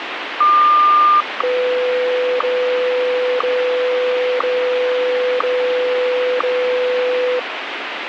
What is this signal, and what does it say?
Radio time signal (WWVH, Hawaii), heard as ticks, one a second, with radio static.